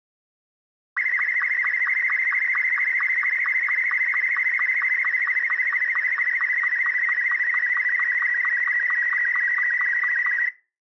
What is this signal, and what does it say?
SSTV (slow-scan television), Martin M2, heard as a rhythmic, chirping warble.